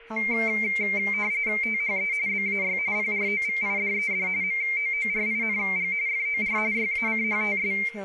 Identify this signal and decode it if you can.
RTTY (45.45 baud, 170 Hz shift), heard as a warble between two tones, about 2200 Hz centre, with a steady whistle near 460 Hz, room echo and speech in English. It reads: THE BAY PROVIDED MOORING FOR YACHTS